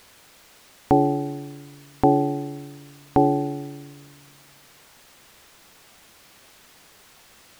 Clock strike, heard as a bell. 3. Three o'clock.